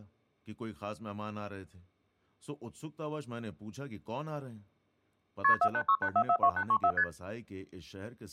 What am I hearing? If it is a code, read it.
Multi-frequency trunk signalling (R1, as on North American trunks), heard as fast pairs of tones, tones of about 70 ms, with speech in Urdu. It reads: KP 4868442834 ST